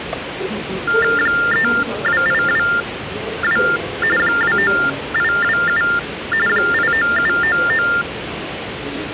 TTY/TDD text telephone tones (45.45 baud Baudot), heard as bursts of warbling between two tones, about 400 Hz shift, 1600 Hz centre, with phone line noise and the noise of a subway station. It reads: 32822 29827 89799